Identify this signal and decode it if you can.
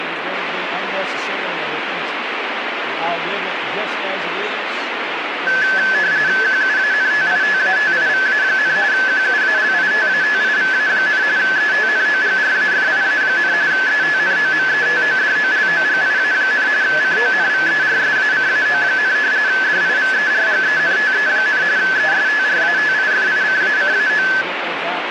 RTTY (45.45 baud, 170 Hz shift), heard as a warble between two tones, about 1600 Hz centre, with radio static. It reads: QUANTITATIVA, QUALITATIVA, ETNOGRAFIA, ETNOMETODOLOGIA, CONVERSACAO, DIVERGENTE, ESTRATIFICACAO